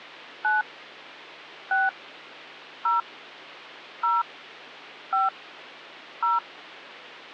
DTMF, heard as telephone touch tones, dialled by hand, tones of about 180 ms, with hum. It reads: 9 6 0 0 5 0